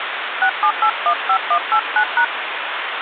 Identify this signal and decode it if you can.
DTMF, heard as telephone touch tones, dialled by hand, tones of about 80 ms, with phone line noise. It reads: 67815189#